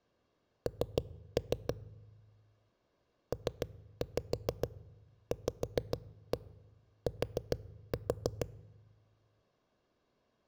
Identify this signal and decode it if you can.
Tap code, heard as knocks on a wall, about 6 knocks a second, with room echo. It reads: N PVT